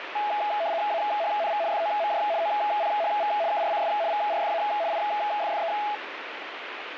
RTTY (75 baud, 170 Hz shift), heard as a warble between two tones, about 750 Hz centre, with radio static. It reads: AHNV FOMJ OPHV KRCS VRFA IFFE